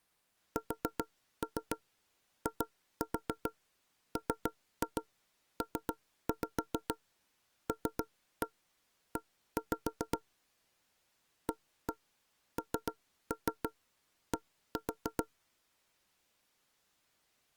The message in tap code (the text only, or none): SIMPLE AND